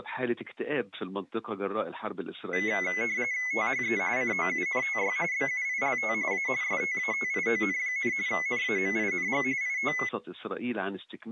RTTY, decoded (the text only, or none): THE COUNTY BUILT A STATION, NAMING IT